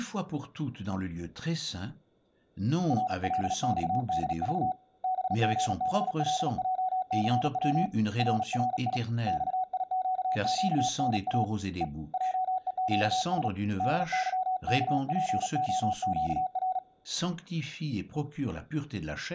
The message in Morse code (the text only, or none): RLXDV BGBLJCW RRI XIQQNA E JEQS DYKPOQR